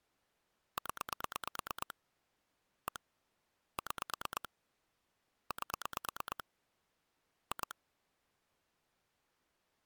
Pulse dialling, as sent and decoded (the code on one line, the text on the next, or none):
10 / 1 / 6 / 8 / 2
0 1 6 8 2